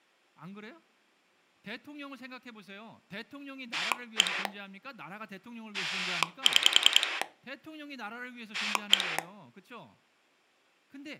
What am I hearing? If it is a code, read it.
Pulse dialling, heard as a rotary dial, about 10 pulses a second, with speech in Korean. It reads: 1 6 1